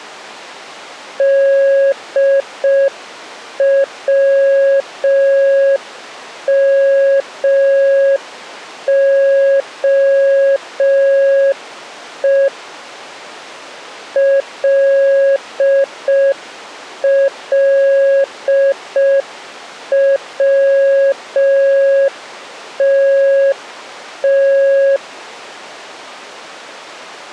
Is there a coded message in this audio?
Yes: Morse code (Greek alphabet) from 1.1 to 25.0 s, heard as a keyed tone, machine-sent, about 5 wpm, 550 Hz. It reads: ΔΩΜΟΕ ΛΛΩΤΤ